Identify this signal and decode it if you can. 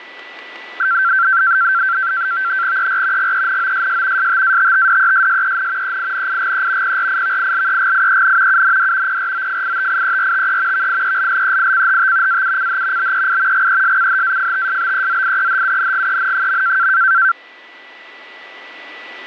NAVTEX (SITOR-B), 100 baud, 170 Hz shift, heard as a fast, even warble, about 1460 Hz centre, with a steady whistle near 1970 Hz. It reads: ER GENOSS STATTDESSEN EINIGE PRIVILEGIEN UND PROFITIERTE VIELLEICHT AUCH BEI GESCHAFTSBEZIEHUNGEN.